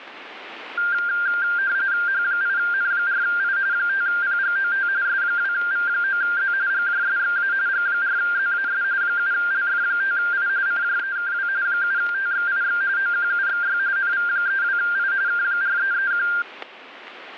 RTTY (45.45 baud, 170 Hz shift), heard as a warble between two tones, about 1500 Hz centre, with static crashes. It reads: H8N4I 5PGOT S2V9Z GJSXA G4ZAS 7LF5I CJEKW 7TXIX OQUXY NV32I K4331